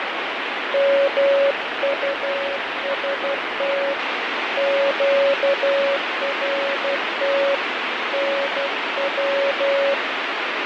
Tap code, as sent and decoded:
none

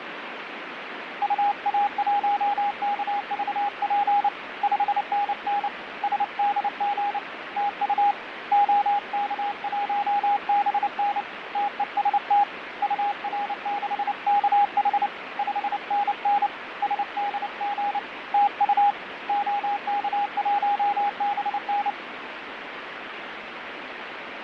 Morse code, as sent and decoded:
..- .- .---- -.- ...- .--. / ..... -. -. / ... -.. --. / - ..- / --- -.- .---- -... -. / - . ... - / ..- .-. -.... -.- .... / ..... -. -. / ... -.. --. / - ..- / --- -.- .---- -... -.
UA1KVP 5NN SDG TU OK1BN TEST UR6KH 5NN SDG TU OK1BN

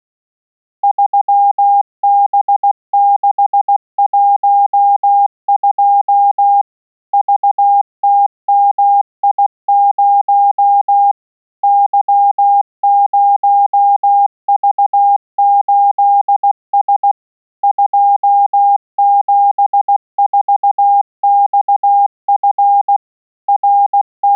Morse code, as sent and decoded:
...-- -... -.... .---- ..--- / ...- - -- .. ----- / -.-- ----- ...- ---.. ... / ..--- --... ....- -..- ..-. / …
3B612 VTMI0 Y0V8S 274XF …

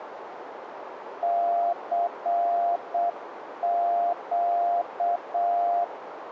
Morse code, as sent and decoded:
-.-. --.-
CQ

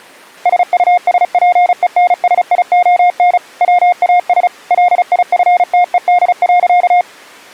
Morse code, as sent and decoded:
... ..- ... .--. . -. ... .. --- -. / .-- .- ... / .-.. .. ..-. - . -.. .-.-.-
SUSPENSION WAS LIFTED.

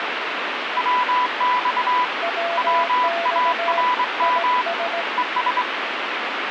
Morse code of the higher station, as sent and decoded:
.-- -..- / .-- .- .-. -- / . ...
WX WARM ES

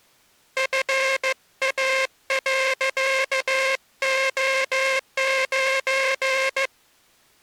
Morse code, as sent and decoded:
..-. .- .-.-.- --- ----.
FA.O9

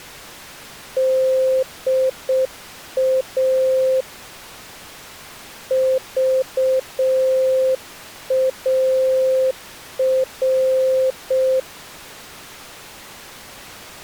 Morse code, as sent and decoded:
-.. .- / ...- .- .-.
DA VAR

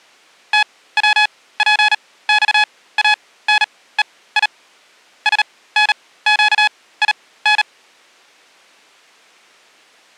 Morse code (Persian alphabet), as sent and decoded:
- .-- .--. -..- .- -. . .. / ... -. --.- .. -.
توپخانهی سنگین

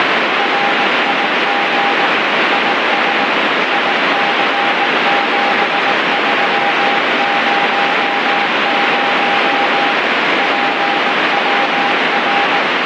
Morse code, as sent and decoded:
.-. .. --. / .. ... / .. -.-. --... ...-- ----- ----- / .--. .-- .-.
RIG IS IC7300 PWR

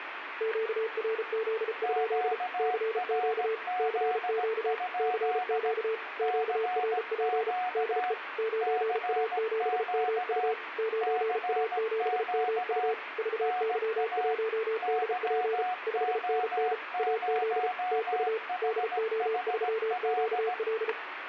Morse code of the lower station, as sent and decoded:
--.- .-. --.. ..--.. / -.-. --.- / -.-. --.- / -.-. --.- / --.- .-. .--. / -.. . / ----. .- --... -- ..- / ----. .- --... -- ..- / ...- -.-- .---- -.. .--. / ..... -. -. / .- --.. / - ..- / -.. --- ...-- --.- .-..
QRZ? CQ CQ CQ QRP DE 9A7MU 9A7MU VY1DP 5NN AZ TU DO3QL

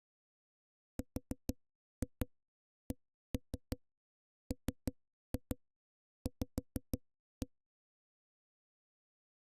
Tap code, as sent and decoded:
4-2 1-3 3-2 5-1
RCMV

